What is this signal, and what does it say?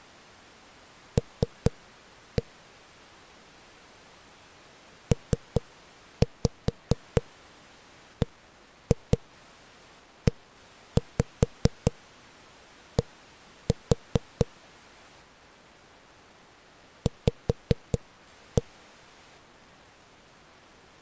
Tap code, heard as knocks on a wall, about 4 knocks a second. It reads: L PBED V